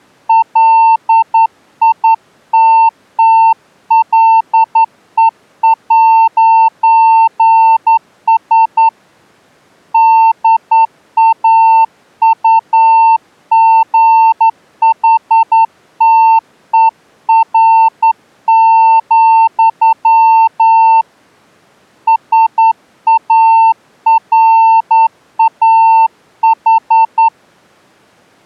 Morse code, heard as a keyed tone, hand-sent with a straight key, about 10 wpm, 900 Hz. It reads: LITTLE'S DAUGHTER, SARAH